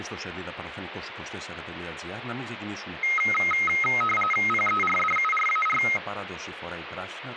RTTY (45.45 baud, 850 Hz shift), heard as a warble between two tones, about 1700 Hz centre, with radio static and speech in Greek. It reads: PERDURAR